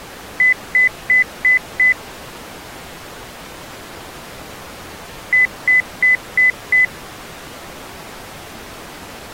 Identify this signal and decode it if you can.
Beep code, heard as beeps, played twice, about 2000 Hz. 5 short. In AMI BIOS tables: processor failure; in Dell tables: CMOS battery failure.